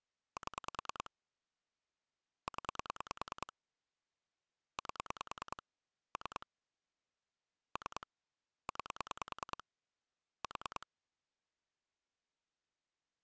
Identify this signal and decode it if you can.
Pulse dialling, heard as clicks on a phone line, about 10 pulses a second. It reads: 7 0 8 3 3 9 4